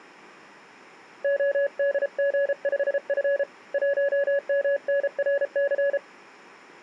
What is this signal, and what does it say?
Morse code, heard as a keyed tone, hand-sent with a paddle, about 33 wpm, 560 Hz. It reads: ODG5F 1MNRC